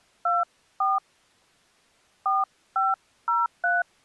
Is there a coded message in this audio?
Yes: DTMF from 0.3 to 3.8 s, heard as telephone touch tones, dialled by hand, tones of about 180 ms. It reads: 24 4503